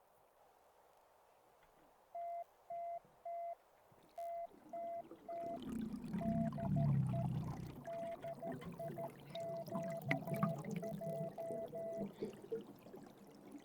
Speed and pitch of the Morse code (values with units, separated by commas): 13 wpm, 680 Hz